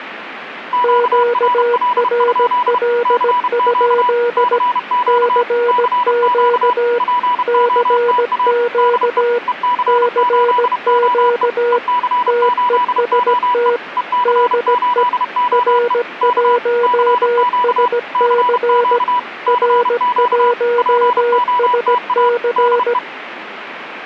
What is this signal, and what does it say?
Morse code, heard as two keyed tones, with radio static. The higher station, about 31 wpm, 980 Hz: QRL? CQ CQ CQ POTA DE EC8OE EC8OE EC8OE K CQ CQ CQ POTA DE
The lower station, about 17 wpm, 480 Hz: QRL? CQ CQ CQ TEST DE R1SC R1SC